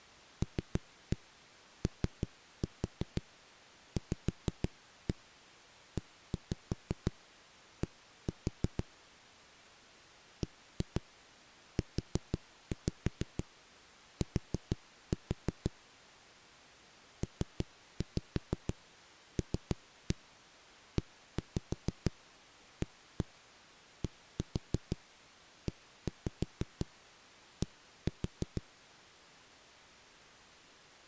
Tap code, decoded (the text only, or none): LOVED BUT PLEADED